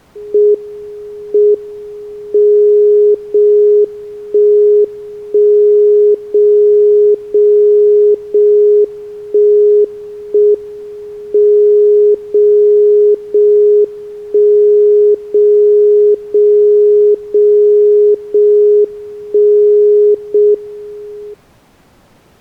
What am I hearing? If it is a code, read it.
Radio time signal (JJY), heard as a tone whose level steps once a second, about 420 Hz. The time is 22:33 Japan time. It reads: M M 0 1 1 0 0 0 1 1 M 0 0 1 0 0 0 0 1 0 M